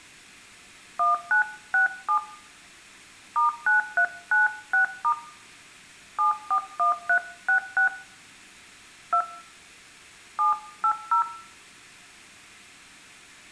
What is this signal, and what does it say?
DTMF, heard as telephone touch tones, dialled by hand, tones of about 120 ms, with room echo. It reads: 1967 *9396* 741366 2 780